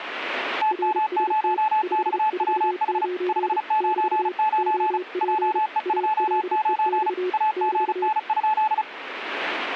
Morse code, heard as two keyed tones. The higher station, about 35 wpm, 860 Hz: TM0XWH 599 JE29 AGN?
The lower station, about 31 wpm, 360 Hz: RST 549 <BT> OP ALEX <BT>